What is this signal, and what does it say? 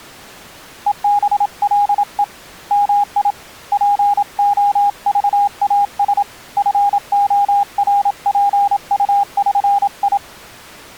Morse code (with Esperanto letters), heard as a keyed tone, hand-sent with a paddle, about 27 wpm, 810 Hz. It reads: EBLE MI POVAS FORPUŜI